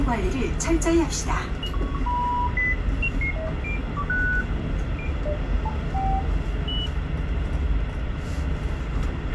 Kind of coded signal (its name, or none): none